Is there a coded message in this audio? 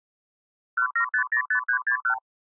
Yes: multi-frequency trunk signalling (R2, with the far end's replies) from 0.8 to 2.2 s, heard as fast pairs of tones, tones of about 90 ms. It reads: 17505361